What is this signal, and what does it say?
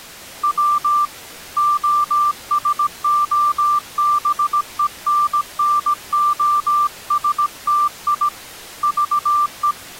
Morse code (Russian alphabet), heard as a keyed tone, hand-sent with a paddle, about 17 wpm, 1180 Hz. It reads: В ОСОБЕННОСТИ ЖЕ